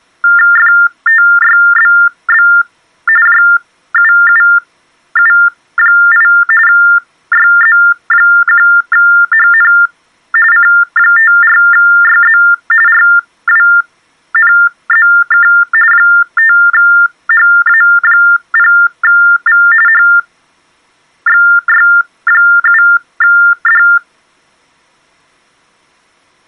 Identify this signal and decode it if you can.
TTY/TDD text telephone tones (45.45 baud Baudot), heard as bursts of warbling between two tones, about 400 Hz shift, 1600 Hz centre. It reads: FTYBB JUUU8 YZ1HN C54YZ RWNZK 5HA0V HXY7D